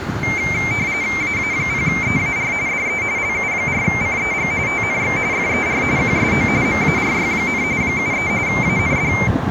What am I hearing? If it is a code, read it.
RTTY (45.45 baud, 170 Hz shift), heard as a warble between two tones, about 2200 Hz centre, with street noise. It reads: AA0EAR DE LU4CEG TNX FER QSO MARY, 73 AND